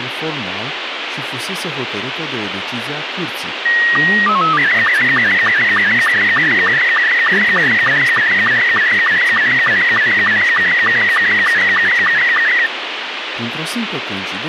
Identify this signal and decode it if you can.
SSTV (slow-scan television), Robot 72, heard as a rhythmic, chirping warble, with radio hiss and speech in Romanian.